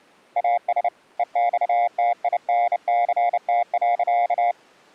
Morse code, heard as a keyed tone, hand-sent with a bug key, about 30 wpm, 700 Hz. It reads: AS EXTINCT.